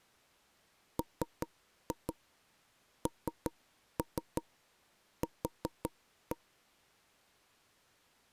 Tap code, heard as knocks on wood, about 5 knocks a second. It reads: MNQ